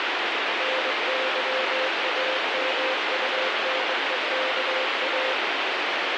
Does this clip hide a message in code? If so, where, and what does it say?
Yes: Morse code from 0.5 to 5.4 s, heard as a keyed tone, hand-sent with a straight key, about 21 wpm, 520 Hz, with heavy radio static. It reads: NYAMUNEKA